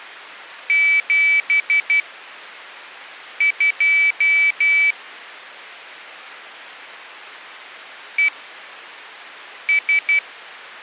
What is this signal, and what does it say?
Morse code, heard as a high beeper, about 12 wpm, spaced as for 5 wpm, 2300 Hz. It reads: 72 ES